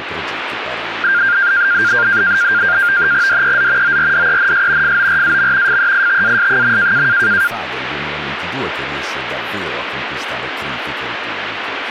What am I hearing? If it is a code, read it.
NAVTEX (SITOR-B), 100 baud, 170 Hz shift, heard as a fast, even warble, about 1500 Hz centre, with radio static. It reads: DEZ ORDENS FORAM FEITAS.